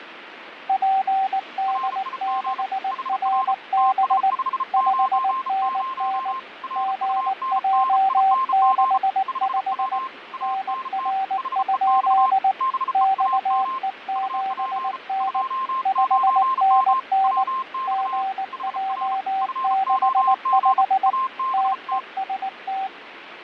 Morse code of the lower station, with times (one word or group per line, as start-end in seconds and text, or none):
0.7-4.3 PD6RB
4.7-6.3 5NN
6.8-10.0 GJ65
10.4-12.5 NR?
12.9-15.4 XE7N
15.9-17.4 5NN
17.9-21.1 GJ65
21.5-22.9 TEST